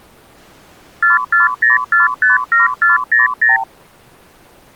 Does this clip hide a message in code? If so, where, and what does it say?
Yes: multi-frequency trunk signalling (R2, with the far end's replies) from 1.0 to 3.6 s, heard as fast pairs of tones, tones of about 150 ms. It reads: 440457400